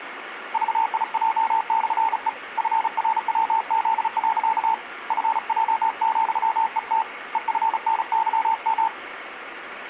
Morse code, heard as a keyed tone, hand-sent with a bug key, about 35 wpm, 900 Hz, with radio static. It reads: VIJ/E FRWZ. FJ,ET EFNYM